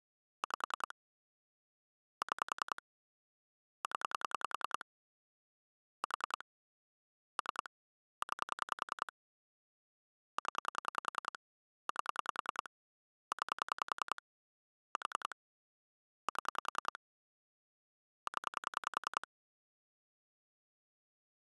Pulse dialling, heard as clicks on a phone line, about 10 pulses a second. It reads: 5 6 0 4 3 9 0 8 9 4 7 0